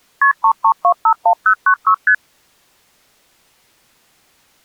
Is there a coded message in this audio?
Yes: multi-frequency trunk signalling (R1, as on North American trunks) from 0.2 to 2.1 s, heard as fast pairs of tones, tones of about 80 ms. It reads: KP 33251096 ST